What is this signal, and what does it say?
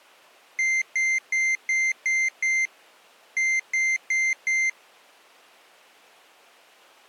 Beep code, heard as a piezo beeper, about 2100 Hz. 6-4.